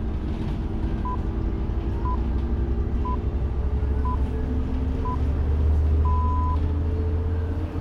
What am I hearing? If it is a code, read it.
Radio time signal (six pips, as the Greenwich Time Signal), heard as pips, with the noise inside a bus.